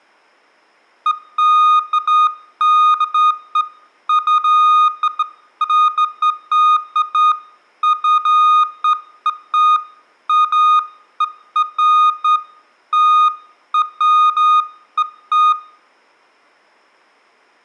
Beeps of irregular length, with room echo. There is no code.